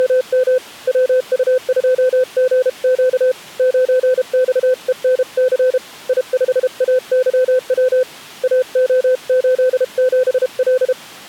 Morse code, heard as a keyed tone, hand-sent with a paddle, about 32 wpm, 510 Hz. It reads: … WU2GQ 9XENC I5AYW AO87L